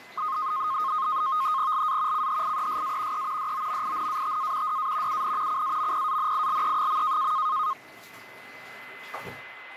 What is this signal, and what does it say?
NAVTEX (SITOR-B), 100 baud, 170 Hz shift, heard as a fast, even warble, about 1160 Hz centre, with a steady whistle near 2040 Hz and the noise of a restroom. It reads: LA CHIESA E DOMINATA DA UN CAMPANILE.